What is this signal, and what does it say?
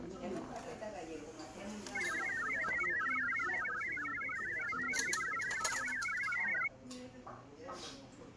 Multi-tone FSK (Olivia or MFSK type), about 1000 Hz wide, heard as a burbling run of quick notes, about 62.5 baud, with the noise of a crowd indoors.